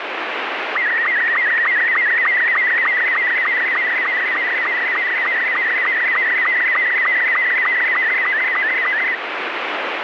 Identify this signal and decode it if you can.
SSTV (slow-scan television), Robot 72, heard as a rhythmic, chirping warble, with radio static.